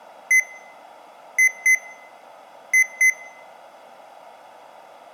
Beep code, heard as beeps from a small speaker, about 2050 Hz, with room echo. 1-2-2. In Phoenix BIOS tables: DMA initialisation failure.